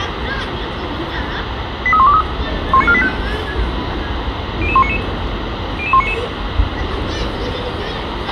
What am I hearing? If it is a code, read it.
Five-tone selective call (ZVEI), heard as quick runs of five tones, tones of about 70 ms, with radio hiss, a squelch burst at the end, room echo and the noise of a residential street. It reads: 83123 19485 00199 00199